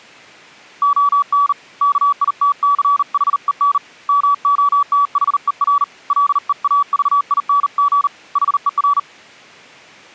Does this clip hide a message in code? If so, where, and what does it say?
Yes: Morse code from 0.8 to 9.1 s, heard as a keyed tone, hand-sent with a bug key, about 39 wpm, 1140 Hz. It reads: ON KITCHEN MOTHER LEAVING HER